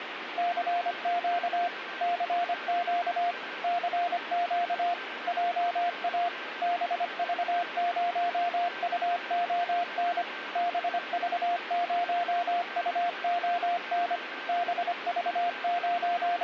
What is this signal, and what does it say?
Morse code, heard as a keyed tone, machine-sent, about 25 wpm, 700 Hz, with radio static and a weaker station near 1560 Hz. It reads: CQ CQ CQ JA BV0UON BV0UON …